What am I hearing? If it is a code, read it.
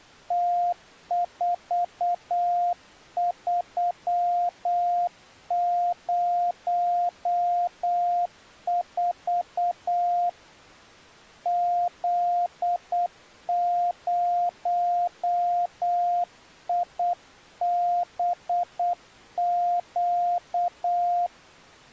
Morse code, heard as a keyed tone, hand-sent with a paddle, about 8 wpm, 700 Hz. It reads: T4304 Z0IBQ